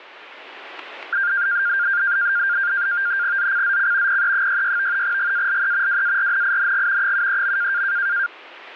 NAVTEX (SITOR-B), 100 baud, 170 Hz shift, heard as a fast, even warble, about 1500 Hz centre. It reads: ZCZC PE66 GALE WARNING 73.